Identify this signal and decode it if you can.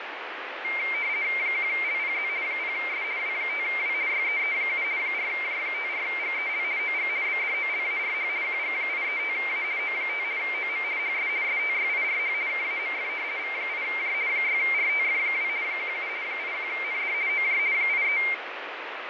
RTTY (50 baud, 170 Hz shift), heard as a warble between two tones, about 2200 Hz centre, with radio static and fading. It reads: 1LPZ 0S W5W YEE7 4J54GEL OG BDOLARH QG835A O5 OM HS STYIRH KAMF V8J 6RTF2 17 81ND OJ 83